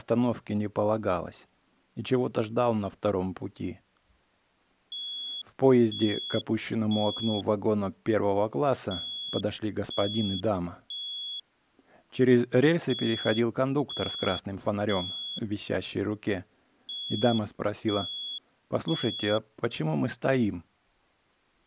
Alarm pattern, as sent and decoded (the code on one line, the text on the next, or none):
3 beeps and a pause
temporal three